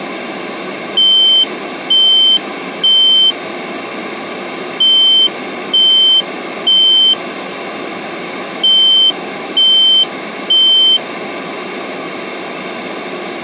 Alarm pattern, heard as an alarm's beeps, played three times, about 3100 Hz. Temporal three. Smoke or fire, evacuate.